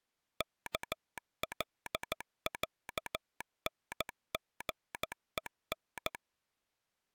Morse code (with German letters), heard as a telegraph sounder, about 14 wpm. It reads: KLÄNGEN